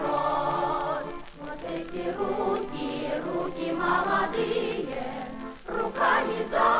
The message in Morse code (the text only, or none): none